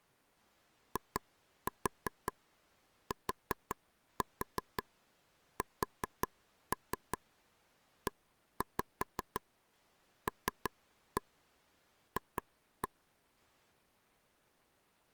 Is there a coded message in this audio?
Yes: tap code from 1.0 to 12.9 s, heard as taps on a table, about 5 knocks a second. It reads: ITSELF